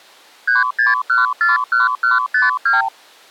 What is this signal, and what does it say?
Multi-frequency trunk signalling (R2, with the far end's replies), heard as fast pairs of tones, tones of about 160 ms. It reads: 36141152